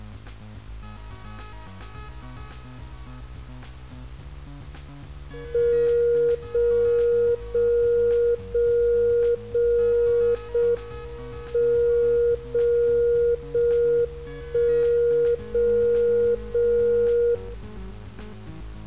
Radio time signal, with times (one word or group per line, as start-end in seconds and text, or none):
5.5-6.5 0
6.5-7.5 0
7.5-8.5 0
8.5-9.5 0
9.5-10.5 0
10.5-11.5 M
11.5-12.5 0
12.5-13.5 0
13.5-14.5 1
14.5-15.5 0
15.5-16.5 0
16.5-17.5 0